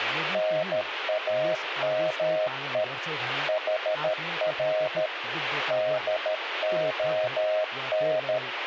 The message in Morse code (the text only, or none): NAME HR DON